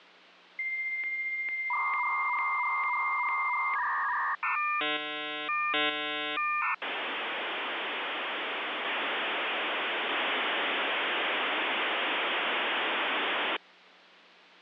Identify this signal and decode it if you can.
Dial-up modem handshake (V.34 or later), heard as a whistle, warbles, then hiss.